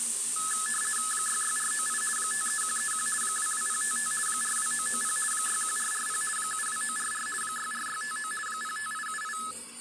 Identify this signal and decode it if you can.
RTTY (50 baud, 450 Hz shift), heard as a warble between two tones, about 1500 Hz centre, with the noise of a restroom. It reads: 66498 53131 22055 42990 61440 72944 64659 05878